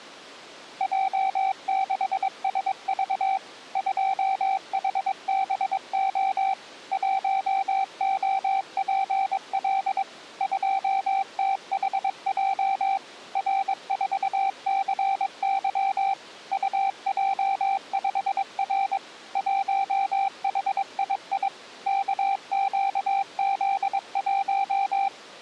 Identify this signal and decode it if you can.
Morse code, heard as a keyed tone, machine-sent, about 22 wpm, 780 Hz. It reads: J6SV 2HBO 1OPL 2THJ R4CY UJ5R 1HII KQZ1